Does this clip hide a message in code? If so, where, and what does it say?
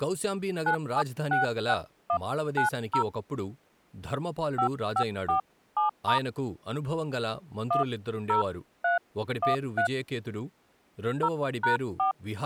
Yes: DTMF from 0.7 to 12.1 s, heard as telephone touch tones, dialled by hand, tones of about 100 ms, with speech in Telugu. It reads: 9766190 5547* 10313 0#4